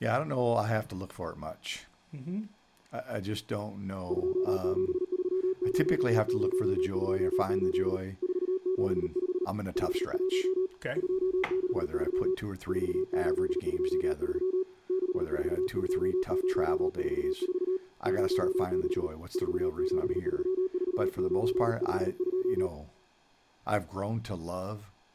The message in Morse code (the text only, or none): 2730028 475 51 263 4823 642044 06 4734952